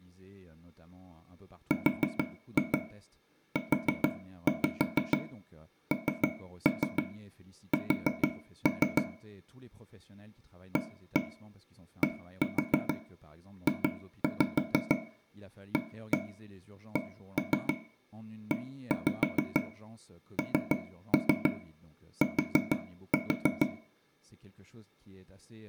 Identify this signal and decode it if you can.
Tap code, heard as taps on a table, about 6 knocks a second, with room echo and speech in French. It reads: RUNS ADJACENT